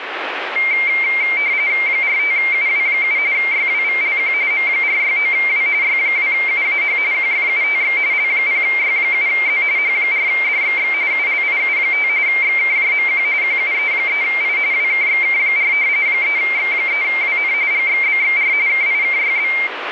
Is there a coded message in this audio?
Yes: RTTY (45.45 baud, 170 Hz shift) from 0.6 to 19.7 s, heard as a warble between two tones, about 2200 Hz centre, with radio static. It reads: 45UW7 YWVLQ M469W Y2UAH QFUTX L0Y7Z H4DXX ULIU5 XKJMQ QUE3I WKXK4 3X3WN GXBXR KIKYB